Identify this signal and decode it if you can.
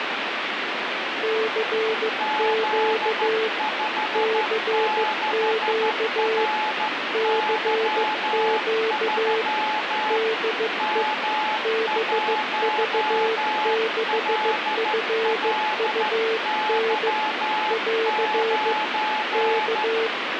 Morse code, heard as two keyed tones, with radio static. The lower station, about 15 wpm, 450 Hz: CQ CQ CQ DE BV6FUN <AR> K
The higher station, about 13 wpm, 860 Hz: Z56RY3 M1LLY9